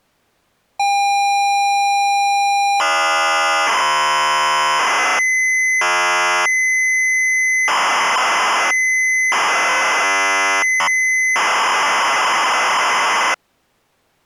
ZX Spectrum tape loading, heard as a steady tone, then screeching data.